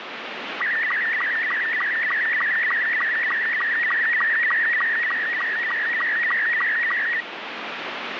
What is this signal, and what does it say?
SSTV (slow-scan television), Robot 72, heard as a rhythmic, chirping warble, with radio static.